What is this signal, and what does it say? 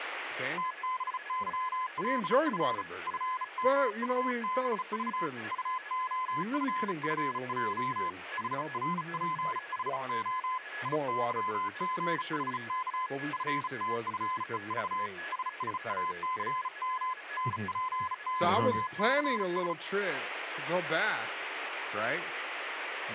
Morse code, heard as a keyed tone, hand-sent with a bug key, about 35 wpm, 1020 Hz, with a weaker station near 1690 Hz and speech in English. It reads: TBYLF FMUBV UOFFJ HRPHO IYGHK FTFEV SSACM NPYCS